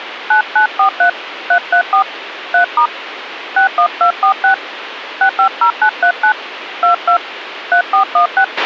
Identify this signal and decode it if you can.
DTMF, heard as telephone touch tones, dialled by hand, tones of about 100 ms, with radio hiss and a squelch burst at the end. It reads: 9943 334 3* 61246 650939 22 3416